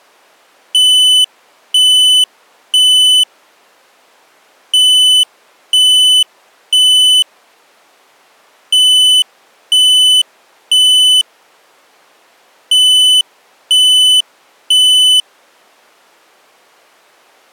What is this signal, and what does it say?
Alarm pattern, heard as an alarm's beeps, played four times, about 3000 Hz. Temporal three. Smoke or fire, evacuate.